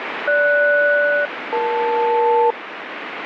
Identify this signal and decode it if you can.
Aircraft SELCAL, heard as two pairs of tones, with radio static. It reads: GS-EL